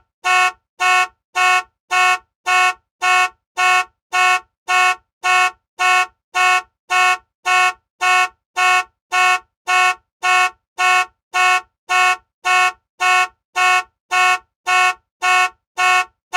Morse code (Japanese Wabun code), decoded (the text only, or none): none